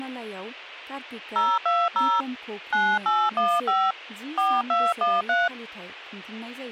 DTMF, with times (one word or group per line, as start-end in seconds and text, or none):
1.4-2.2 020
2.7-3.9 9815
4.4-5.5 4213